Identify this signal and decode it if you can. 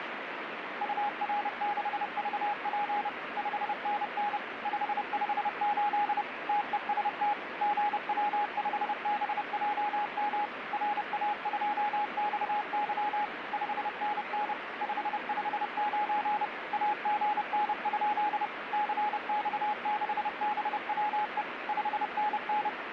Morse code, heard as a keyed tone, machine-sent, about 30 wpm, 830 Hz, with radio static. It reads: UR6VP 5NN 558 TEST GW5BJM RA2XY 5NN 559 AGN? CX6BWE 5NN